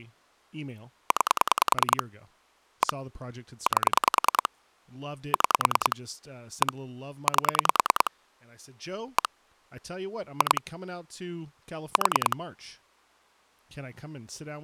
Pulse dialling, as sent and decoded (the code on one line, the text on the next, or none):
9 / 1 / 8 / 6 / 1 / 8 / 1 / 2 / 4
9 1 8 6 1 8 1 2 4